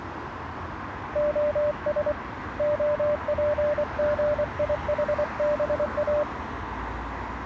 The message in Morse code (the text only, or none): OS OPGIHBA